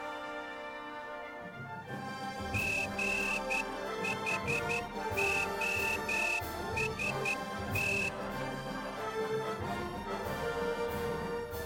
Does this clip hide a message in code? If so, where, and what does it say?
Yes: Morse code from 2.5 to 8.1 s, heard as a whistle, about 11 wpm. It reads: GHOST